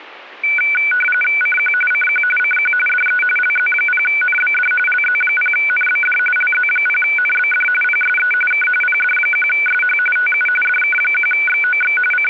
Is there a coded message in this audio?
Yes: RTTY (45.45 baud, 850 Hz shift) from 0.4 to 12.3 s, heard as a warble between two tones, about 1900 Hz centre. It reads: CQ CQ CQ DE LZ0NBD LZ0NBD LZ0NBD PSE K PD1SH TU DK1XOX …